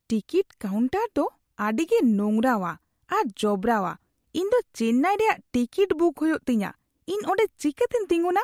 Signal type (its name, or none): none